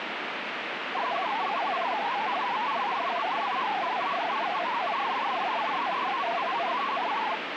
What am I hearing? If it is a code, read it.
Multi-tone FSK (Olivia or MFSK type), about 500 Hz wide, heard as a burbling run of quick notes, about 62.5 baud, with radio static.